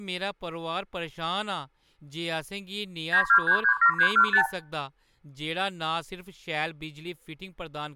Multi-frequency trunk signalling (R2, with the far end's replies), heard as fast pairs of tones, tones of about 90 ms, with room echo and speech in Dogri. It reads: 92337315